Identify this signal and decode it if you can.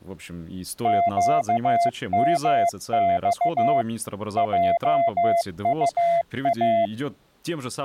Morse code, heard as a keyed tone, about 15 wpm, 680 Hz, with speech in Russian. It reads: QMX JUA